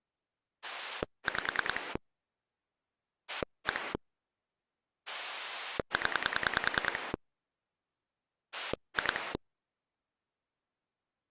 Pulse dialling, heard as a rotary dial, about 10 pulses a second. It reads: 5 1 0 2